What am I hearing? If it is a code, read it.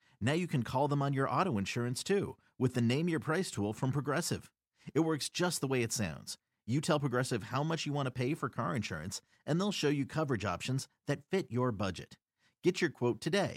Speech in English. There is no code.